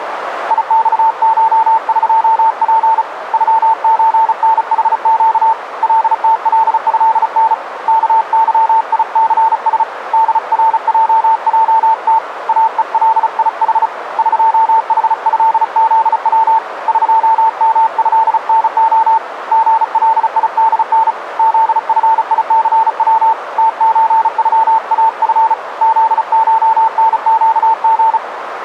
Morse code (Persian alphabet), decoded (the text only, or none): یخشقپ غچنحگ لتلضن کظیثس درججت اهلیح قحضزو قمضنع ژلیدن زفیثو تچغاف زشنگژ